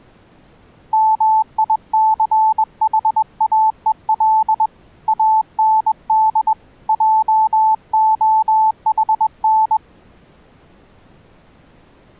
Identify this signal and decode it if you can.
Morse code, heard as a keyed tone, hand-sent with a straight key, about 21 wpm, 880 Hz. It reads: MICHAEL AND JOHN